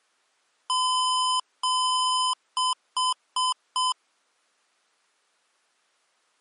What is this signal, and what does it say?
Beep code, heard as beeps from a small speaker, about 1020 Hz. 2 long, 4 short.